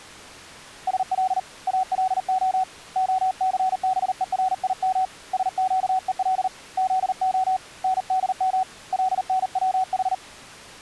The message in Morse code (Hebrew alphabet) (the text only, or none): של אלה הסבורים שקול זה נדם לנצח